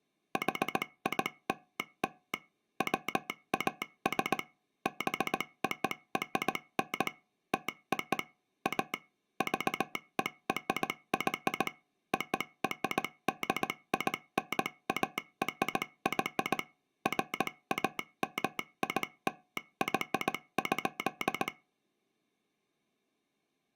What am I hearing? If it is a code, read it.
Morse code (American railroad code), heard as a telegraph sounder, machine-sent. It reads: HILL WAS BORN TO A VERY ORDINARY FAMILY.